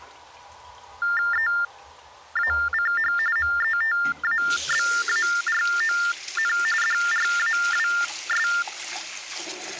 TTY/TDD text telephone tones (45.45 baud Baudot), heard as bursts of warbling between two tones, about 400 Hz shift, 1600 Hz centre, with the noise of a restroom. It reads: EACH METABARON DRAWS